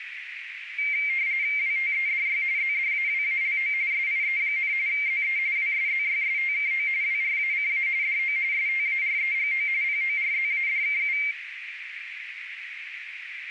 RTTY (45.45 baud, 170 Hz shift), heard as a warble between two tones, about 2200 Hz centre, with radio static and a narrow filter. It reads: WTEDY ZDAWALO SIE, ZE WSZYSTKO WRACA DO STAREGO PORZADKU